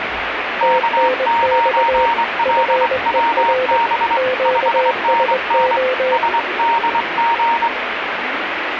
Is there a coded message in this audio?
Yes: Morse code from 0.5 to 7.7 s, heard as two keyed tones, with radio static and the noise of a crowd indoors. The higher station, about 24 wpm, 930 Hz: K9LWB 5NN SDG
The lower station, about 21 wpm, 510 Hz: TNX FER QSO